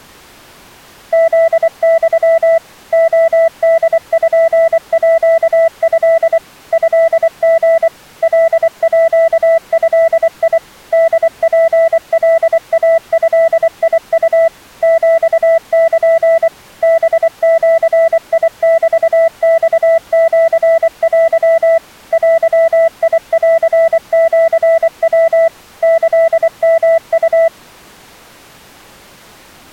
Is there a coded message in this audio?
Yes: Morse code (Japanese Wabun code) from 1.1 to 27.5 s, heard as a keyed tone, machine-sent, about 24 wpm, 660 Hz. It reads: フユ レポート トリ カード ホツカイドウ ヒル ハジメマシテ デンシヤ キヨウ